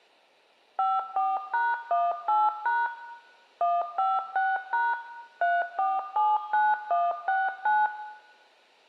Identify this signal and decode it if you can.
DTMF, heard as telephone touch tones, dialled by machine, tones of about 210 ms, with room echo. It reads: 54#18# 156# 3479169